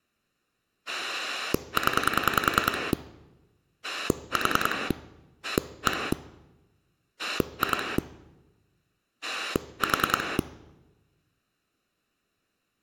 Pulse dialling, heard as a rotary dial, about 10 pulses a second. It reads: 0 4 1 2 4